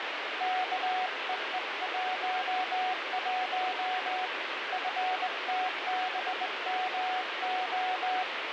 Morse code, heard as a keyed tone, hand-sent with a straight key, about 20 wpm, 740 Hz, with heavy radio static. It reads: KEE11 FTBMO